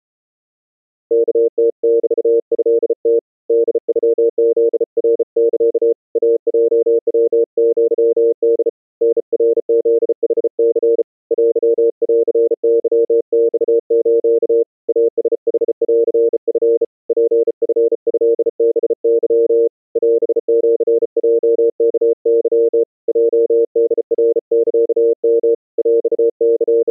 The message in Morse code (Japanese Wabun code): ワムメトム ホノフナサ イヲヤアホ タナフヌニ テンケマス イラヌンチ ツチトハケ オシヲワケ ヲホナサヨ …

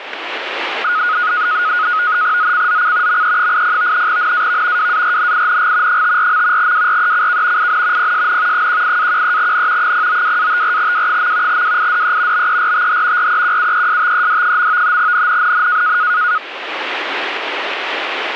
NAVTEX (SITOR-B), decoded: ZCZC ME80 NAV WARNING 54. WRECK IN PSN 18-13N 092-54W. WIDE BERTH REQUESTED. NNNN

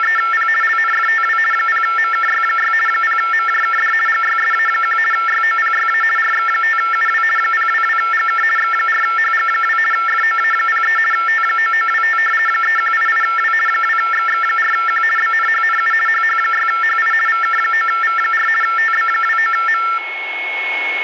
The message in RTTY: … LNFTW 0MKY6 0MJKD GYSA1 YOPYA RX5UW 022GK X4HG2 FOA03 T9925 3188W 2XX4Q BNHNU HH6HI VK9V4 TB29M

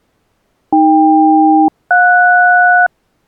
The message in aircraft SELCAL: AK-JS

